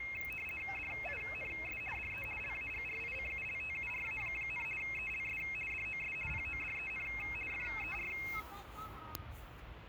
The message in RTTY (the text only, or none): DINS DE LAGRICULTURA, ELS DOS PODEN FER